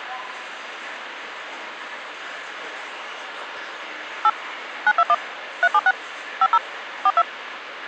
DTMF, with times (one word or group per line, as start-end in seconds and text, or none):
4.2-4.3 8
4.9-5.1 921
5.6-5.9 376
6.4-6.6 50
7.1-7.2 42